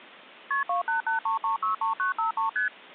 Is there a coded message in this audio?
Yes: multi-frequency trunk signalling (R1, as on North American trunks) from 0.5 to 2.7 s, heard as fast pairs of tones, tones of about 120 ms. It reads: KP 2883363953 ST